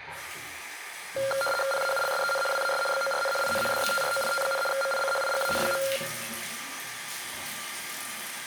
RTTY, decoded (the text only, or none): PAULSEN WAS BORN IN DETROIT, MICHIGAN.